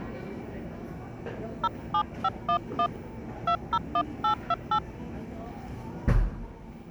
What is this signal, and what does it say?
DTMF, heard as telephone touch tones, dialled by hand, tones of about 70 ms, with the noise of a cafe. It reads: 07511 201828